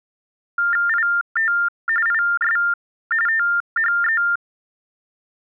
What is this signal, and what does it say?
TTY/TDD text telephone tones (45.45 baud Baudot), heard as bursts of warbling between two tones, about 400 Hz shift, 1600 Hz centre. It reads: IT IS THE